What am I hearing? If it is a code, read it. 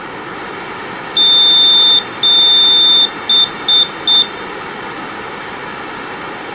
Beep code, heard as a piezo beeper, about 3600 Hz, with room echo. 2 long, 3 short.